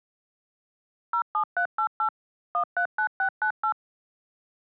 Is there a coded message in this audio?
Yes: DTMF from 1.1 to 3.7 s, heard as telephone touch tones, dialled by machine, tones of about 90 ms. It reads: 07388 139698